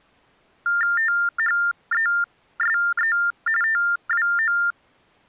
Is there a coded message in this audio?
Yes: TTY/TDD text telephone tones (45.45 baud Baudot) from 0.7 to 4.7 s, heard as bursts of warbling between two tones, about 400 Hz shift, 1600 Hz centre. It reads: THESE TWO